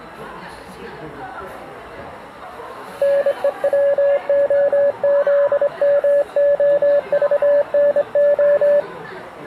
Morse code (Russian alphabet), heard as a keyed tone, hand-sent with a straight key, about 25 wpm, 570 Hz, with the noise of a cafe. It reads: НЕВОЗМОЖНО